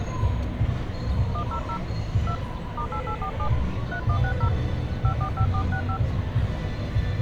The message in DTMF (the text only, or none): 100 2 *8847 3160 545465